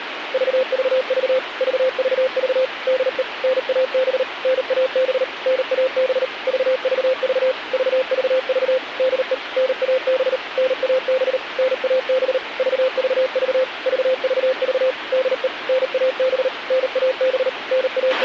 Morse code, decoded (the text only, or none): VVV VVV DE NAB NAB NAB VVV VVV DE NAB NAB NAB VVV VVV DE NAB NAB …